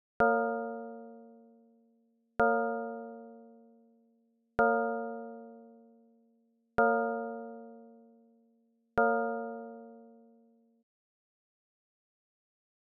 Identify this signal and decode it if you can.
Clock strike, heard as a bell. 5. Five o'clock.